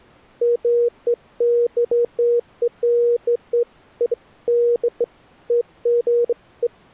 Beeps of irregular length. There is no code.